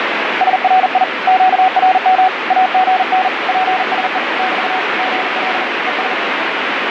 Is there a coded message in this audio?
Yes: Morse code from 0.4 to 6.2 s, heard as a keyed tone, hand-sent with a paddle, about 40 wpm, 750 Hz, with heavy radio static. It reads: SRI QRM AGN PSE <BT> GL ES